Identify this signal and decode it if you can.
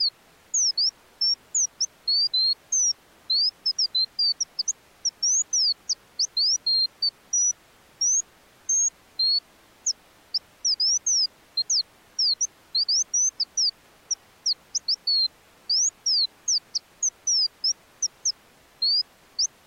Bird-like chirps. There is no code.